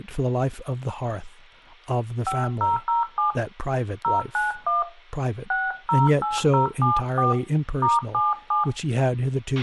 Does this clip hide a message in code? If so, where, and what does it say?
Yes: DTMF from 2.3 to 8.6 s, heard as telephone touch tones, dialled by hand, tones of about 160 ms, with a squelch burst at the end and speech in English. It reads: 5007 091 608074 *77